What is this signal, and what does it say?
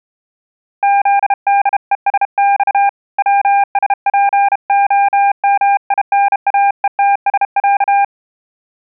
Morse code (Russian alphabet), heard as a keyed tone, hand-sent with a bug key, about 32 wpm, 800 Hz. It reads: ЗДЕСЬ ВСПОМИНАЕТСЯ